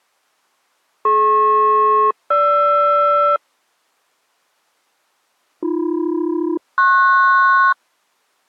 Aircraft SELCAL, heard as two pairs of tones. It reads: DP-GR AB-PS